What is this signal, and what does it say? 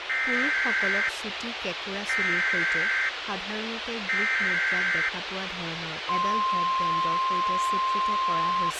Emergency Alert System (SAME) tones (header bursts, then the 1050 Hz attention tone), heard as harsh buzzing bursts, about 520.83 baud, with radio hiss and speech in Assamese.